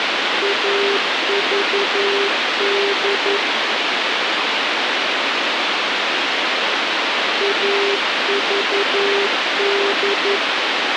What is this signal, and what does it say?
Morse code, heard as a keyed tone, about 11 wpm, 400 Hz, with radio hiss. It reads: AVD AVD